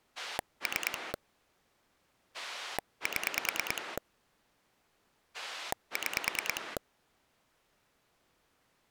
Pulse dialling, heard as a rotary dial, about 9 pulses a second. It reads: 3 7 6